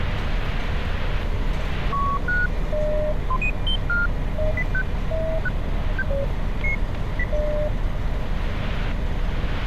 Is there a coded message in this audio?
No, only electronic bleeps of random pitch and length, with static crashes and street noise.